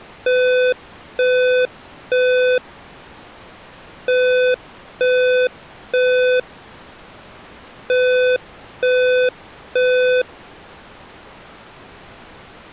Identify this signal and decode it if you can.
Alarm pattern, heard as an alarm's beeps, played three times, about 500 Hz. Temporal three. Smoke or fire, evacuate.